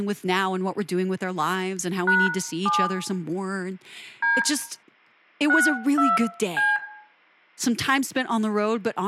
DTMF, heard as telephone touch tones, dialled by hand, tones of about 200 ms, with room echo and speech in English. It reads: #7 D 62C